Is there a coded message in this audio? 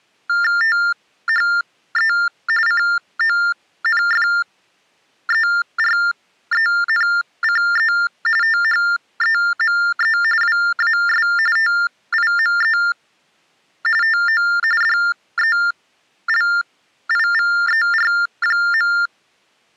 Yes: TTY/TDD text telephone tones (45.45 baud Baudot) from 0.3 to 19.1 s, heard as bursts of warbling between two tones, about 400 Hz shift, 1600 Hz centre. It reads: THE CONFERENCE THEME WAS TIME TO DELIVER.